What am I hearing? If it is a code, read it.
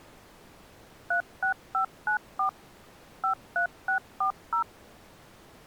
DTMF, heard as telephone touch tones, dialled by machine, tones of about 100 ms. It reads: 36594 53640